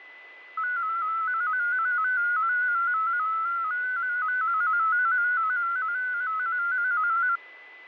Multi-tone FSK (Olivia or MFSK type), about 250 Hz wide, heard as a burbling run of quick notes, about 15.625 baud, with a steady whistle near 2010 Hz.